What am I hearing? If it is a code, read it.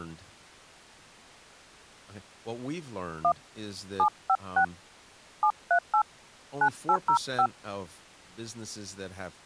DTMF, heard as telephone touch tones, dialled by hand, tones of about 70 ms, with speech in English. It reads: 1 756 738 9805